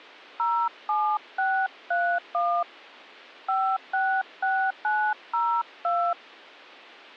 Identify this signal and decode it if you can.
DTMF, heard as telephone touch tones, dialled by hand, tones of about 280 ms. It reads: 07631 566902